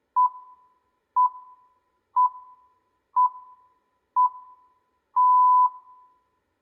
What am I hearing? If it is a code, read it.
Radio time signal (six pips, as the Greenwich Time Signal), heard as pips, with room echo.